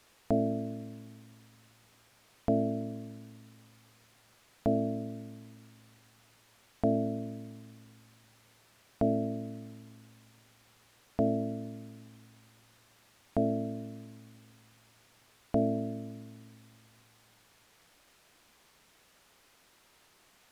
Clock strike, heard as a bell. 8. Eight o'clock.